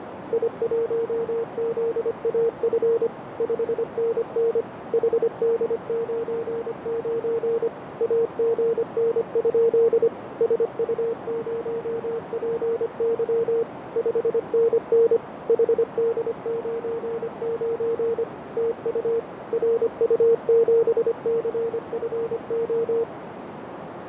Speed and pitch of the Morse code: 25 wpm, 460 Hz

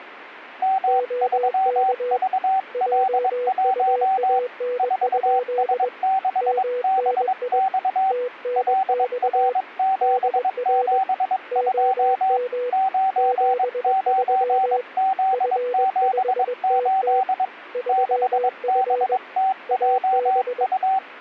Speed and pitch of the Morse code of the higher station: 22 wpm, 770 Hz

